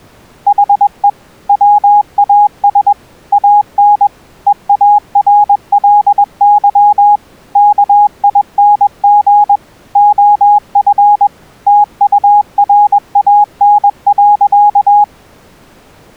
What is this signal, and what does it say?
Morse code, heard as a keyed tone, machine-sent, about 21 wpm, 830 Hz. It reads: HE WAS AN EARLY KING OF TURAN.